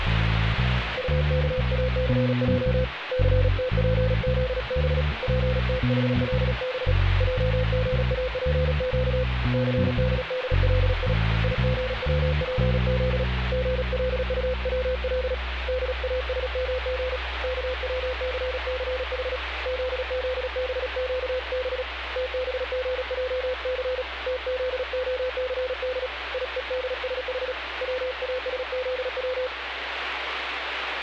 Morse code (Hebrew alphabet), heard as a keyed tone, hand-sent with a paddle, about 36 wpm, 510 Hz, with radio static. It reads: טכאסע סתפזב פתחלב עגאפק סדדלי יגצפז גלטצל דאשמג כצססח זזבקב תבגעס תזהסד יודשח צאשזץ